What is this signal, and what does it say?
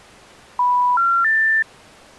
Telephone call progress tone (North American plan), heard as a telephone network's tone, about 980, 1370, 1800 Hz. Special information tone.